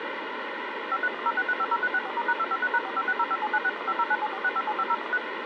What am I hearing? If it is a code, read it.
DTMF, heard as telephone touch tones, dialled by machine, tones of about 50 ms, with phone line noise. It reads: 53106350364*#253#456057961509746575013